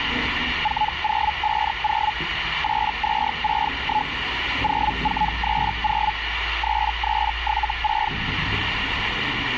Hellschreiber (Feld-Hell, 122.5 baud), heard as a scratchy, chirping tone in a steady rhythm, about 850 Hz, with radio static and the noise inside a lift. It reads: 4050 8261 0430 3376